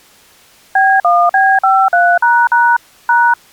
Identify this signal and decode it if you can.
DTMF, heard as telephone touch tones, dialled by machine, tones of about 250 ms. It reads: B1B53## #